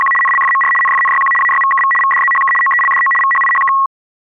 RTTY (75 baud, 850 Hz shift), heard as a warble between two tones, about 1500 Hz centre. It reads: … NLFMR NFNYQ AYVKV VDZHK OELDO VHIHK